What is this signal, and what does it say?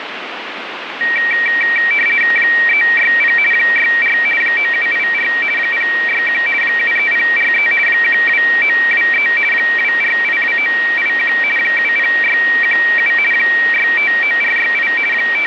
RTTY (50 baud, 450 Hz shift), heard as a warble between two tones, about 2100 Hz centre, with radio static. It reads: 360 64 9784 061 73043 12923 2482981 70617 659468 …